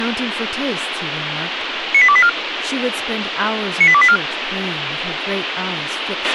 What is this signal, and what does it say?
Five-tone selective call (ZVEI), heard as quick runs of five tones, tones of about 70 ms, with radio hiss, a squelch burst at the end and speech in English. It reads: 98284 98284